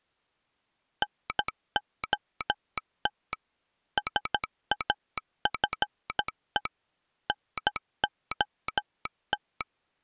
Morse code, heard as a telegraph sounder, machine-sent, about 13 wpm. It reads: NOT SAFE NOT